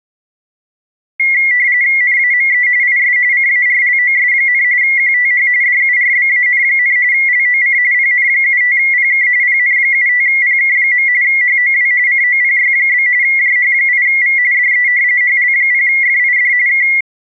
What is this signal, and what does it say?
RTTY (45.45 baud, 170 Hz shift), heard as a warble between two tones, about 2050 Hz centre. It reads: NAME IS CARLOS, QTH DURBAN, LOC PN75PK PN75PK. HOW COPY? JH8V DE HL0FID K